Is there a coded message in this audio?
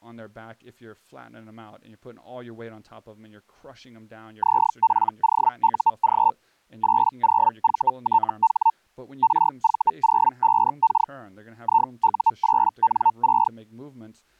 Yes: Hellschreiber (Feld-Hell, 122.5 baud) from 4.4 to 13.5 s, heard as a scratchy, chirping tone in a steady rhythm, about 900 Hz, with speech in English. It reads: ZPOUG 80VTH RV05K IU8N6